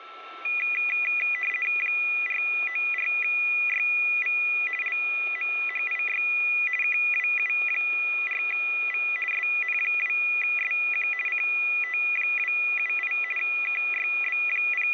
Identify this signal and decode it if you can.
RTTY (50 baud, 450 Hz shift), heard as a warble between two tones, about 2200 Hz centre, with a steady whistle near 1330 Hz. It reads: 494YV LMHIY KWU4V SN2SQ CT278 …